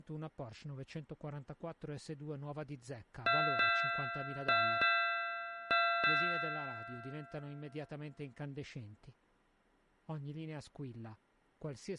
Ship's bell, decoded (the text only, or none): 6